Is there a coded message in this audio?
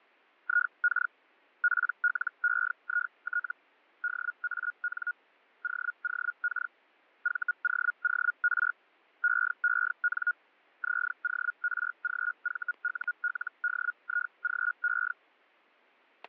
Yes: Hellschreiber (Feld-Hell, 122.5 baud) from 0.4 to 15.1 s, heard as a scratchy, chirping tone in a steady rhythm, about 1440 Hz, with static crashes. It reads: IK PLEIT DAN OOK VOOR EEN ZORGVULDIGE